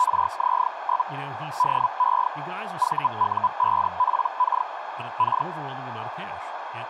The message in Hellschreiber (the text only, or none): … DE VU5PK K